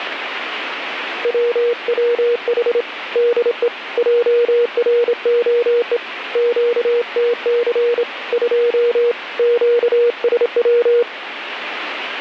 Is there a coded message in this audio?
Yes: Morse code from 1.2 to 11.1 s, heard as a keyed tone, hand-sent with a straight key, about 27 wpm, 480 Hz, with radio static. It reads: WWH DE JROE QTC 2 QSW